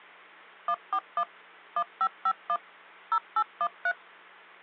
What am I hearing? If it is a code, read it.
DTMF, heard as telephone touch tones, dialled by machine, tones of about 60 ms, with hum. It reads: 141 1551 0813